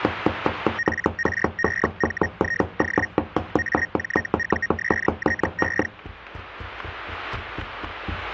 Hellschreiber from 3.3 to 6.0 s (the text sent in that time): AJUSTE